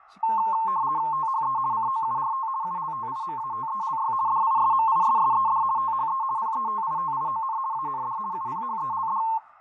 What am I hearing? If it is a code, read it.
RTTY (50 baud, 170 Hz shift), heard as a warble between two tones, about 980 Hz centre, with fading and speech in Korean. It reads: THE COURT ULTIMATELY DISMISSED THE PETITION AND UPHELD